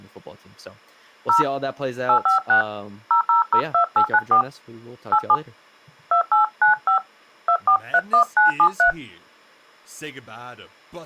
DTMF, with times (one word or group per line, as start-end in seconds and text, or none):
1.3-1.4 0
2.1-2.6 856
3.1-4.4 0002894
5.1-5.4 87
6.1-7.0 2895
7.5-8.9 2431973